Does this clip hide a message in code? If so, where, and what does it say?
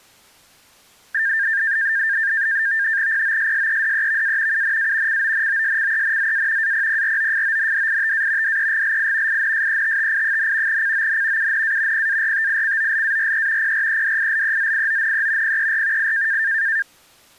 Yes: NAVTEX (SITOR-B), 100 baud, 170 Hz shift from 1.1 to 16.8 s, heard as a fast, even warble, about 1700 Hz centre. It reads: POSSEDEVA UNA CONOSCENZA APPROFONDITA DEGLI INSETTI, CON UNA PARTICOLARE PREDILEZIONE PER I